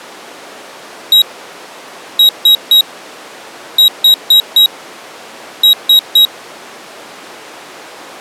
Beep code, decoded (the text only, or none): 1-3-4-3